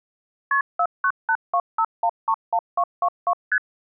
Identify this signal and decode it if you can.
Multi-frequency trunk signalling (R1, as on North American trunks), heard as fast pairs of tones, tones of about 60 ms. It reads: KP 49825131222 ST